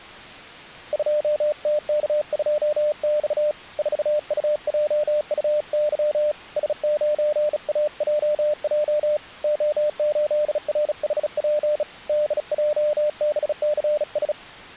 Morse code, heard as a keyed tone, hand-sent with a bug key, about 36 wpm, 600 Hz. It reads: 2TK2X 4UJUY S9AJJ O8RHP DJBCS